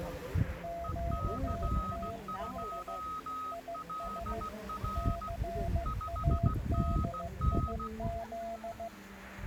Morse code, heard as two keyed tones, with the noise of a park. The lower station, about 15 wpm, 680 Hz: QTH IS CADIZ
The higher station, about 16 wpm, 1260 Hz: EC2LR 5NN